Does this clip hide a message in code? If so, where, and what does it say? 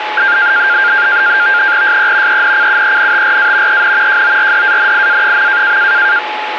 Yes: NAVTEX (SITOR-B), 100 baud, 170 Hz shift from 0.2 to 6.2 s, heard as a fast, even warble, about 1500 Hz centre, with radio static and a steady whistle near 850 Hz. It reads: SE ENCUENTRA EN JORDANIA.